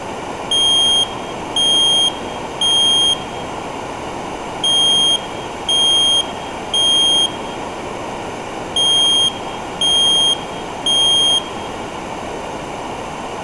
Alarm pattern, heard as an alarm's beeps, played three times, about 3200 Hz, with room echo. Temporal three. Smoke or fire, evacuate.